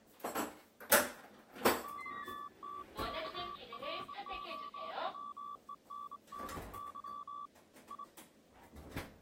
Morse code (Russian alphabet), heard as a keyed tone, hand-sent with a straight key, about 25 wpm, 1160 Hz, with kitchen noise. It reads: ОТКРОВЕННЫ И